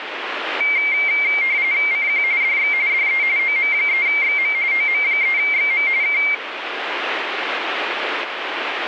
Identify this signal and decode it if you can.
RTTY (45.45 baud, 170 Hz shift), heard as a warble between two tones, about 2200 Hz centre, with radio static. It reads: CQ DX DE OM3XM OM3XM K